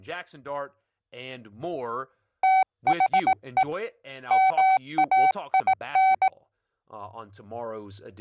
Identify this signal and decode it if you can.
Morse code, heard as a keyed tone, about 18 wpm, 760 Hz, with speech in English. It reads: THE MAIN